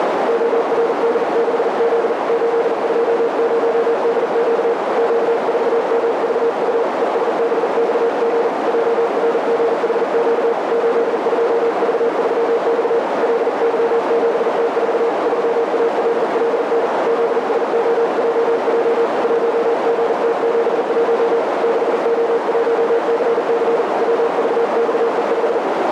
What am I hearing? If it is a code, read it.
Morse code, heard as a keyed tone, hand-sent with a paddle, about 40 wpm, 460 Hz, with heavy radio static and a narrow filter. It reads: ORD6Z 820DQ Q4MVU ESBXG JRGHQ 82V3X LY7T4 3ALLN ZSOJJ 1GT71 6O1CC WVXE5